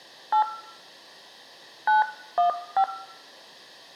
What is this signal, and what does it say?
DTMF, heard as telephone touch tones, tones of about 110 ms, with room echo. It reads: 8 915